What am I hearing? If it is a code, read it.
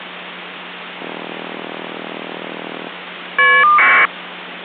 Caller ID data burst, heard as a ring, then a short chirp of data, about 1200 baud, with phone line noise.